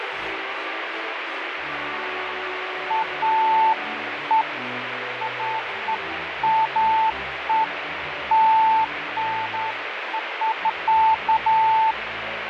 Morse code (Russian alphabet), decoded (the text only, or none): none